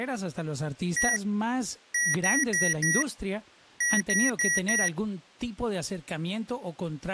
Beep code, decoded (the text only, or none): 1-4-4